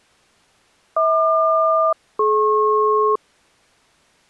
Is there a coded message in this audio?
Yes: aircraft SELCAL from 1.0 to 3.2 s, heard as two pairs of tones. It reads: HQ-DP